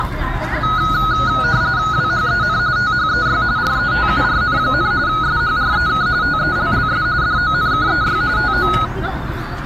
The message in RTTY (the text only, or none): WHEN THEY RETURN, SHREK TELLS DONKEY TO